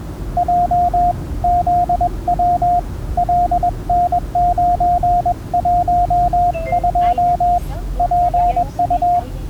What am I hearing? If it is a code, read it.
Morse code, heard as a keyed tone, hand-sent with a paddle, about 21 wpm, 710 Hz, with the noise inside a car. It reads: J ZW LN912 PU